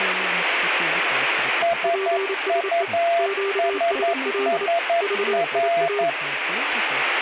Morse code, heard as two keyed tones, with radio static and speech in Japanese. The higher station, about 11 wpm, 680 Hz: SUSSR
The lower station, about 28 wpm, 400 Hz: PSE QSL VIA